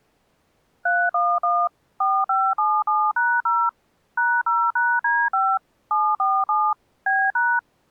DTMF, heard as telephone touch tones, dialled by machine, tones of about 240 ms. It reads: 311 4577#0 #0#D5 747 B#